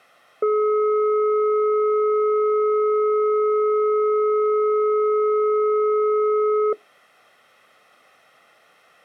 Telephone call progress tone (425 Hz plan, as in most of Europe), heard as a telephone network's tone, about 420 Hz. Dial tone.